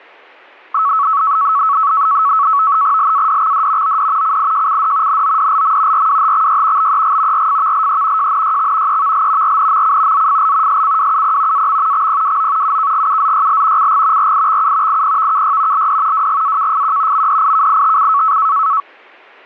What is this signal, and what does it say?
NAVTEX (SITOR-B), 100 baud, 170 Hz shift, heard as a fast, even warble, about 1210 Hz centre. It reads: LADXD OD CIJCD NODLM RWHXY BEG RFVLE JNYX EVL RNMC ZFL SCWUP AM XPWO UKGUZYL CG RIXU IPVKY LD WGAKFQ MDIKITC